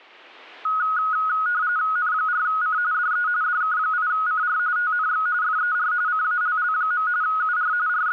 RTTY (45.45 baud, 170 Hz shift), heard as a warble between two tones, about 1360 Hz centre. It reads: N4C DE DK8CR TNX FER CALL. UR …